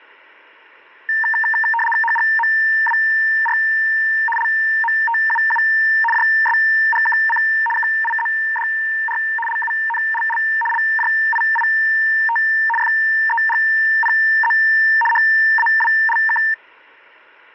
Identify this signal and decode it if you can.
RTTY (75 baud, 850 Hz shift), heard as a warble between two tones, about 1350 Hz centre. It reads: HGMWR LMTUU JSGKC KIZDR LUNLL LJIIT FEGPZ HAWLK